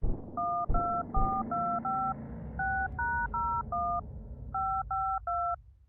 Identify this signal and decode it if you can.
DTMF, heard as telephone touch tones, dialled by hand, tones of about 280 ms. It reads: 12425 6#01 552